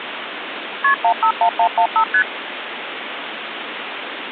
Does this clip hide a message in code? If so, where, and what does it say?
Yes: multi-frequency trunk signalling (R1, as on North American trunks) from 0.8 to 2.2 s, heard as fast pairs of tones, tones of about 80 ms, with phone line noise. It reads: KP 151115 ST